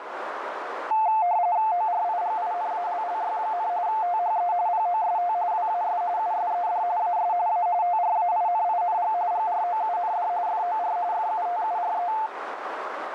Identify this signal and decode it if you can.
RTTY (45.45 baud, 170 Hz shift), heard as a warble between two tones, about 790 Hz centre, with radio static and a narrow filter. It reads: ORIGINALLY, THE POST WAS USED AS A TRAINING GROUND FOR FUTURE